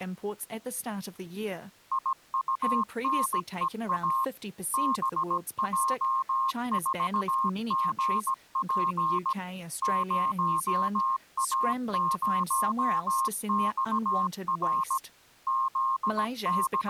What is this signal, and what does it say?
Morse code, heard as a keyed tone, machine-sent, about 17 wpm, 1070 Hz, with speech in English. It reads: IUNEA BJ4GP 0A0XR …